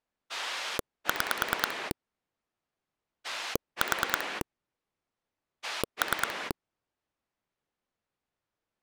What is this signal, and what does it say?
Pulse dialling, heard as a rotary dial, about 9 pulses a second. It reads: 6 4 3